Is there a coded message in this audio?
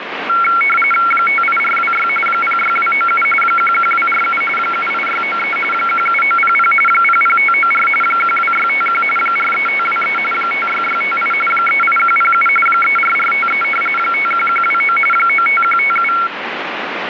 Yes: RTTY (45.45 baud, 850 Hz shift) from 0.3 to 16.3 s, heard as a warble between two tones, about 1800 Hz centre, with radio static. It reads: 58426 06297 11247 78693 17900 00594 12651 43523 56658 38107 34453 51129 95157